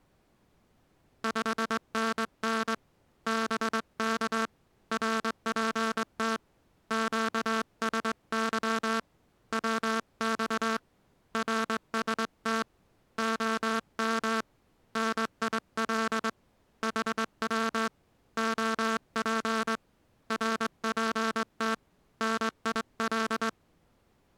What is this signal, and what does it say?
Morse code, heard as a buzzer, hand-sent with a straight key, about 21 wpm. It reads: 5NN BK RPT QSY WX RST OM NIL HW OP RPT NIL